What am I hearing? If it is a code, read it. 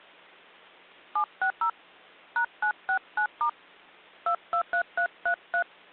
DTMF, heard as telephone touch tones, dialled by hand, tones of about 90 ms. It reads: 760 #969* 223333